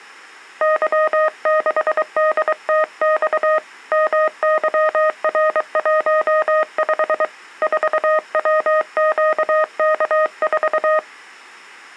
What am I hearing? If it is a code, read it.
Morse code, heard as a keyed tone, hand-sent with a paddle, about 23 wpm, 620 Hz. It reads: Y6DTX MYR15 4WQK4